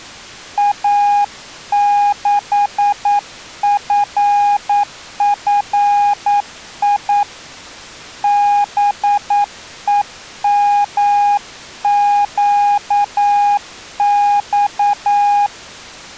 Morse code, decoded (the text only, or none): A6FFI BEMQX